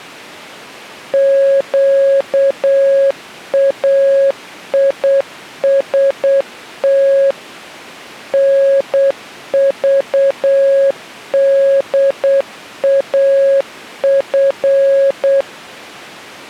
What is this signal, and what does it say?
Morse code, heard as a keyed tone, machine-sent, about 8 wpm, 550 Hz. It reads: QAIST NVDAF